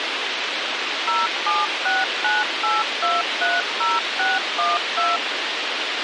DTMF, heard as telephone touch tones, dialled by machine, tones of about 190 ms, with radio hiss and a squelch burst at the end. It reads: 07698230612